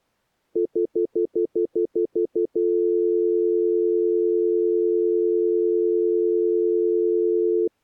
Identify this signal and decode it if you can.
Telephone call progress tone (North American plan), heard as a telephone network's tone, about 350, 440 Hz, 0.1 s on and 0.1 s off. Stutter dial tone.